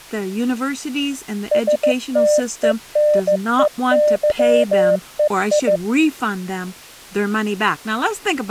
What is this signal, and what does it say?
Morse code (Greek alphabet), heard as a keyed tone, machine-sent, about 15 wpm, 600 Hz, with speech in English. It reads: ΣΤΕΝΕΥΕΙ